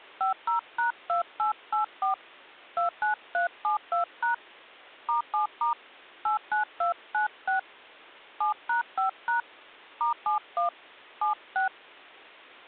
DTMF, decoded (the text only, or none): 50#2884 29372# *7* 89296 7#5# *71 76